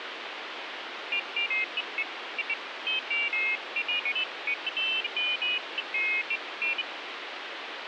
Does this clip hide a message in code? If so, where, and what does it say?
No, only pairs of high tones at irregular times, with phone line noise.